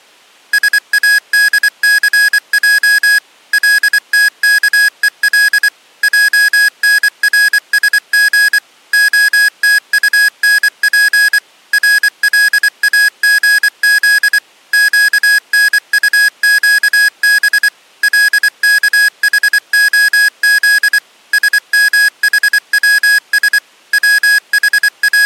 Morse code (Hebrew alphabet), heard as electronic beeps, machine-sent, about 24 wpm, 1650 Hz. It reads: שאדסע לתכול ענרשג התטנף רלאגז קנטקב לכחהז שמחצש …